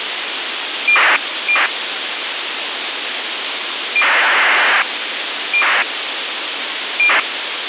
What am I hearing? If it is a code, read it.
ACARS aircraft data, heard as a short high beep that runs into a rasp, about 2400 baud, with radio hiss.